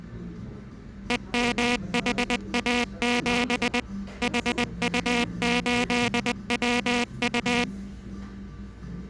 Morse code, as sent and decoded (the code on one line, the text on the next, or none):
. -- .... .- --... / .... ..- ---.. .-- ..-
EMHA7 HU8WU